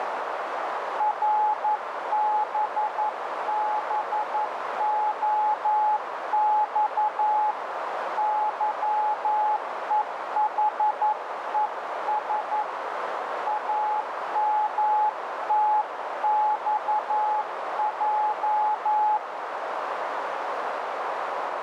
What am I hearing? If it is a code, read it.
Morse code, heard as a keyed tone, hand-sent with a paddle, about 11 wpm, 850 Hz, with heavy radio static and a narrow filter. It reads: RBBOX YEHES AMTXJ